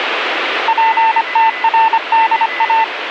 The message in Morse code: PTRDA

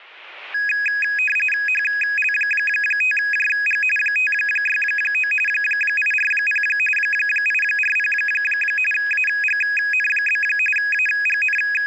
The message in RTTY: HL5JG 569 840 840 AGN? …

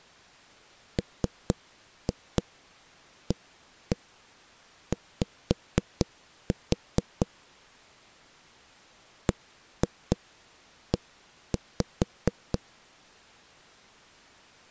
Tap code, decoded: MAY BE

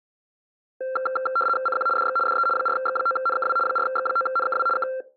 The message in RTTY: CQ DX DE 4X9NKW 4X9NKW K

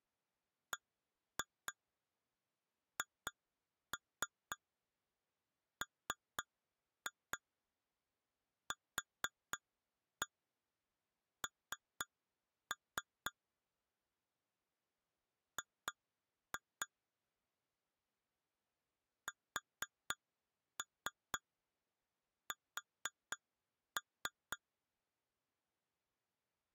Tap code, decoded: BHMQN G SS

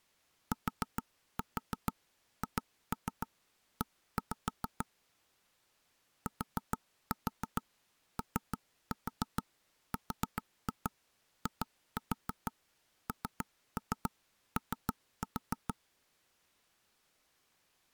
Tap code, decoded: THE TORINO

